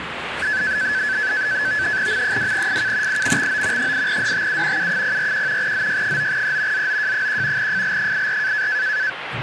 NAVTEX (SITOR-B), 100 baud, 170 Hz shift, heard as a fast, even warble, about 1600 Hz centre, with radio static and the noise inside a lift. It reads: M2FK IMXO 8DTU U041 ZY9E ZOJ1 FL84